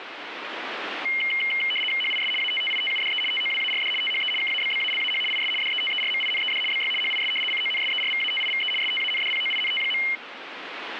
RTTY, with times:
2.0-2.3 HIS
2.4-3.2 ATTITUDE
3.3-3.9 TOWARD
4.0-4.3 THE
4.4-5.2 KABBALAH
5.3-5.5 IS
5.6-6.6 DETERMINED
6.7-6.9 BY
7.0-7.3 HIS
7.5-8.7 CONSERVATIVE
8.8-10.0 STANDPOINT.

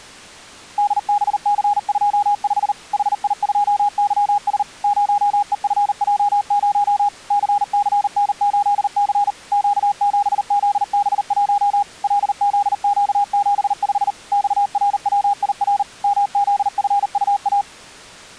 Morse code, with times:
0.8-2.7 DBC25
2.9-4.6 HI2YS
4.8-7.1 0EFJ0
7.3-9.3 CCN8C
9.5-11.8 Q7ZB1
12.0-14.1 LZQ75
14.3-15.8 XRWIR
16.0-17.6 MZFUA

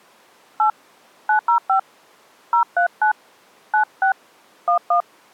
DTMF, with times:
0.6-0.7 8
1.3-1.8 905
2.5-3.1 039
3.7-4.1 96
4.7-5.0 11

